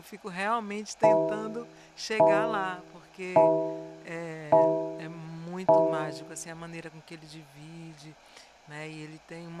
Clock strike, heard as a bell, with room echo and speech in Portuguese. 5. Five o'clock.